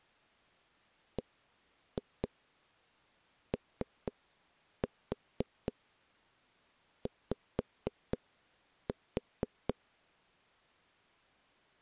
Tap code, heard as knocks on a wall, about 4 knocks a second. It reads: BOY